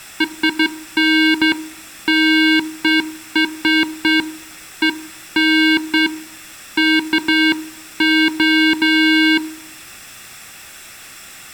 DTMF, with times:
none

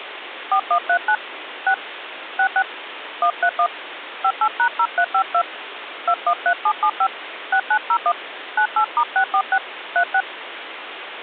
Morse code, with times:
none

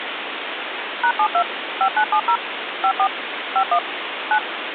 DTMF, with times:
1.0-1.4 #72
1.8-2.4 5970
2.8-3.1 54
3.6-3.8 51
4.3-4.4 9

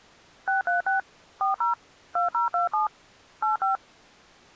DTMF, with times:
0.5-1.0 636
1.4-1.7 40
2.2-2.9 2027
3.4-3.8 85

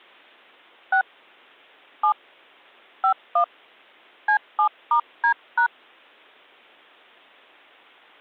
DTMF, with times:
0.9-1.0 6
2.0-2.1 7
3.0-3.4 51
4.3-5.7 C7*D#

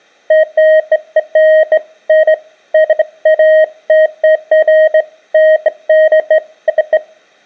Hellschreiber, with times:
none

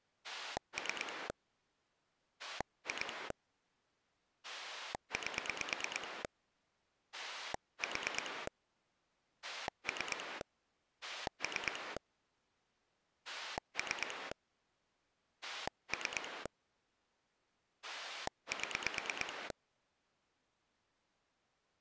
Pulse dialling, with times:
0.2-1.3 3
2.4-3.3 2
4.4-6.2 8
7.1-8.5 4
9.4-10.4 3
11.0-12.0 3
13.3-14.3 3
15.4-16.5 3
17.8-19.5 7

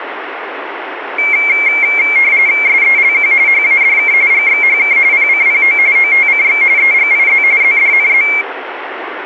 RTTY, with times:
2.7-3.3 SELQ
3.5-4.1 HADK
4.3-5.0 GXHK
5.1-5.8 PCPO
6.0-6.6 OTCX
6.8-7.4 EGIZ
7.6-8.3 ZDNZ

